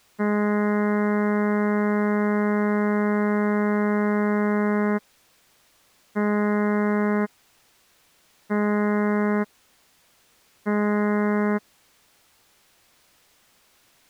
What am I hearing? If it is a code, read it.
Ship horn signal, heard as a ship's horn, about 210 Hz. 1 long, 3 short. At sea: a vessel under tow in fog.